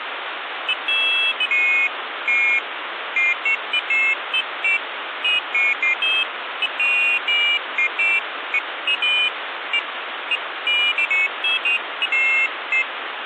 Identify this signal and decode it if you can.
Pairs of high tones at irregular times, with phone line noise. There is no code.